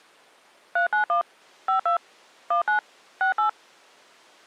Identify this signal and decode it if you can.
DTMF, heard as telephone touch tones, dialled by machine, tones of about 110 ms. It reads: 391 52 19 68